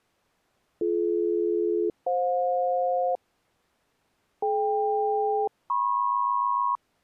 Aircraft SELCAL, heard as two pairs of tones. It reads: BD-FJ DK-MP